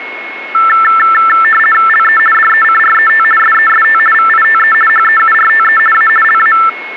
RTTY (50 baud, 450 Hz shift), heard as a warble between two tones, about 1550 Hz centre, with a steady whistle near 2180 Hz. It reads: LE DECRET SEST VITE HEURTE A LA